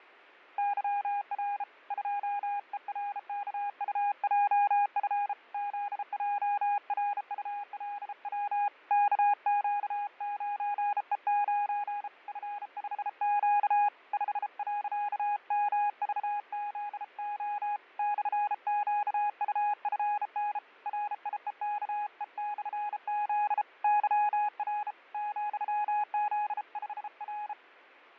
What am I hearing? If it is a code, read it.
Morse code, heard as a keyed tone, hand-sent with a bug key, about 33 wpm, 820 Hz, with fading. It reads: YR 2ERKUJF ZJRULW KQ9E9 F5Q 5.MVZO /QUFN RIEKE/Z YR ,Z5R